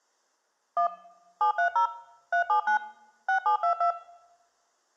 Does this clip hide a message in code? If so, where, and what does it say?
Yes: DTMF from 0.8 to 3.9 s, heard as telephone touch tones, dialled by machine, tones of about 100 ms. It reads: 1 730 379 6722